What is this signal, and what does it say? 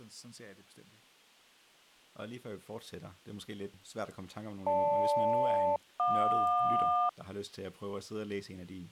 Aircraft SELCAL, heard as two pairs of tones, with speech in Danish. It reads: GL-JQ